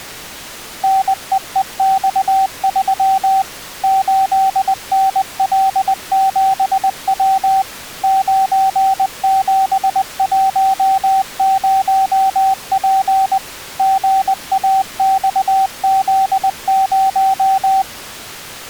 Morse code, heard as a keyed tone, machine-sent, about 20 wpm, 770 Hz. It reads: NEEX3 8NL7W 9710P GAXZ0